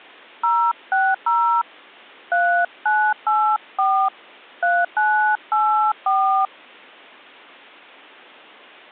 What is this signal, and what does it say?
DTMF, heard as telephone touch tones, dialled by hand, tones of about 300 ms. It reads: 060 3984 3984